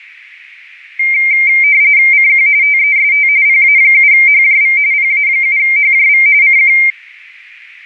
RTTY (45.45 baud, 170 Hz shift), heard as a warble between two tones, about 2200 Hz centre. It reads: CQ TEST PA7HJV PA7HJV CQ